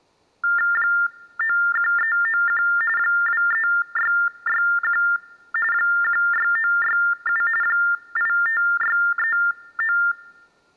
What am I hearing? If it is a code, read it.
TTY/TDD text telephone tones (45.45 baud Baudot), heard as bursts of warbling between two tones, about 400 Hz shift, 1600 Hz centre. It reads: 91391 23661 16967 85639